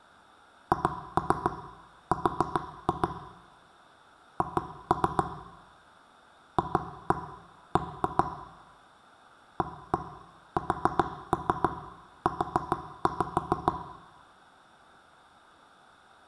Tap code, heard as knocks on wood, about 7 knocks a second, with room echo. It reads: HR H FB ASU